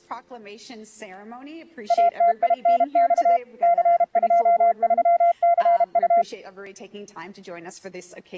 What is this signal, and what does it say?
Morse code, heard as a keyed tone, machine-sent, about 32 wpm, 690 Hz. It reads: ATINX C23CU